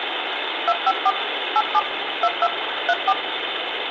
DTMF, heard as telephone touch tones, dialled by machine, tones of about 50 ms, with phone line noise and room echo. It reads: 254 87 22 34